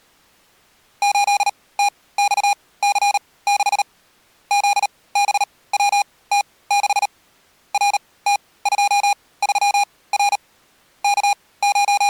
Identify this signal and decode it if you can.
Morse code, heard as electronic beeps, machine-sent, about 38 wpm, spaced as for 21 wpm, 810 Hz. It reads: 8TXC6 ZBWT6 RT23R …